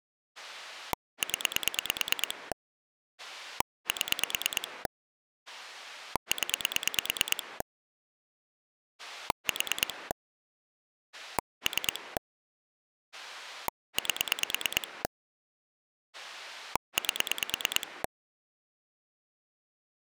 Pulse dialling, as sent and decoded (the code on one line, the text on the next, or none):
10 / 7 / 10 / 4 / 3 / 8 / 8
0 7 0 4 3 8 8